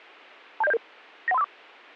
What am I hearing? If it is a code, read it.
Five-tone selective call (EIA), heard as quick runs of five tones, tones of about 30 ms, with a squelch burst at the end. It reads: 27077 91354